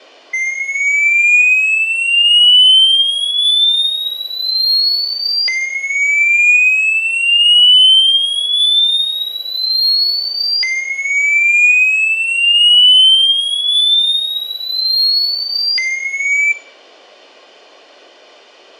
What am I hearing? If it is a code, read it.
A tone that sweeps in pitch again and again, with room echo. There is no code.